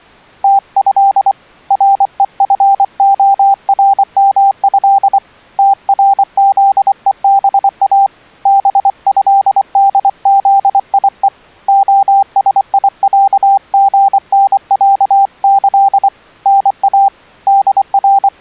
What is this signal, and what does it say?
Morse code (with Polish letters), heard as a keyed tone, hand-sent with a paddle, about 24 wpm, 790 Hz. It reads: TĘ REFORMĘ TRZEBA BĘDZIE OSIĄGNĄĆ NA …